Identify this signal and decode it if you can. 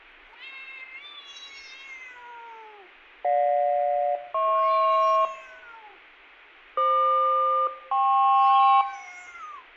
Aircraft SELCAL, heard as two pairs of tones, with room echo. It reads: GJ-HP FQ-KP